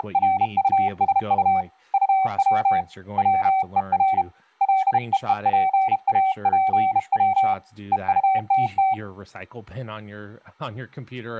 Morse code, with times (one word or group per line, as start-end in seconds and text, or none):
0.0-1.6 …
1.9-2.8 UW
3.2-4.2 WER
4.6-7.5 LEEPAPW
7.9-8.9 EUTT